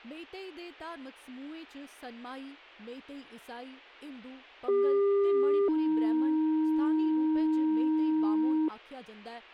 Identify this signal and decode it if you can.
Two-tone page, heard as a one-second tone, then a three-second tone, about 400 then 310 Hz, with speech in Dogri.